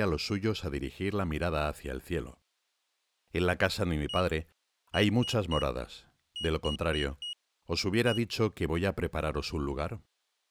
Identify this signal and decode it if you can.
Beep code, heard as a piezo beeper, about 2900 Hz, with speech in Spanish. 1-3-4-1. In Phoenix BIOS tables: memory failure on an address line.